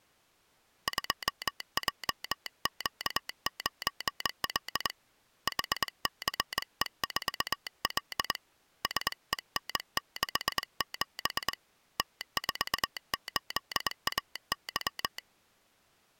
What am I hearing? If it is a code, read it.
Morse code, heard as a telegraph sounder, hand-sent with a straight key, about 22 wpm. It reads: 2JQ9L HCE4L SEN67 T48AY